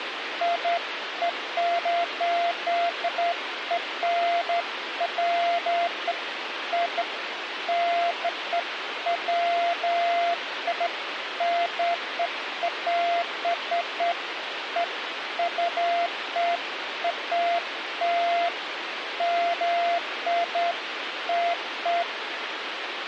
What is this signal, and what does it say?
Beeps of irregular length, with phone line noise. There is no code.